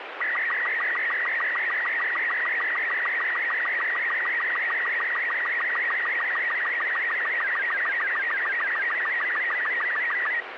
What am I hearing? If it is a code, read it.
SSTV (slow-scan television), Robot 36, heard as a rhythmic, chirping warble, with radio static.